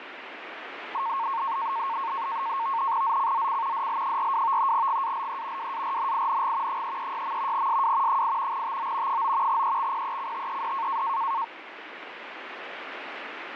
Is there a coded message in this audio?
Yes: NAVTEX (SITOR-B), 100 baud, 170 Hz shift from 0.9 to 11.4 s, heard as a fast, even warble, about 1000 Hz centre, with radio static. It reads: ZCZC DL42 GALE WARNING 336. SW 8 TO 9 EXPECTED